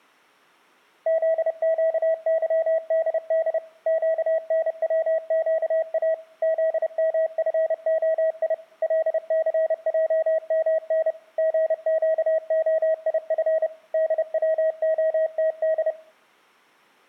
Morse code, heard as a keyed tone, machine-sent, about 30 wpm, 640 Hz. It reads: ZQYDD QNWQA ZMFOI LCJMN GQOIF DWOTD